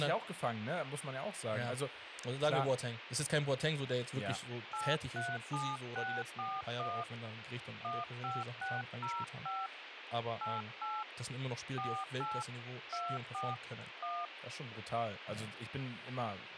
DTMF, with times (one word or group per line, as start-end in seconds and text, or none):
4.7-7.0 837641
7.8-9.7 15605
10.4-11.0 88
11.8-12.4 48
12.9-13.5 24
14.0-14.3 1